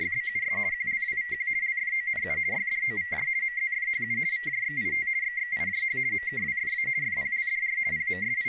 RTTY (50 baud, 170 Hz shift), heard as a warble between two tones, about 2000 Hz centre, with speech in English. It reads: … QLWVQ LFONU YDOVJ MZFHU VJXIT XXIJH MKWFA FPLDR …